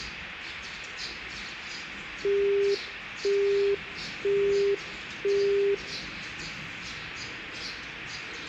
Telephone call progress tone (single-tone plan, as in Europe, Japan and elsewhere), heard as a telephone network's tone, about 400 Hz, 0.5 s on and 0.5 s off, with the noise of a park. Busy tone.